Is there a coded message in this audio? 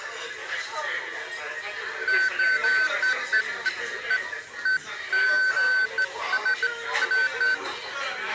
No, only beeps of irregular length, with the noise of a crowd indoors.